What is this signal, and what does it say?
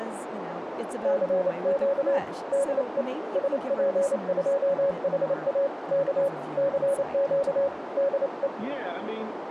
Morse code, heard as a keyed tone, hand-sent with a paddle, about 28 wpm, 560 Hz, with radio static, a narrow filter and speech in English. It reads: CQ DE SP2HA K CQ DE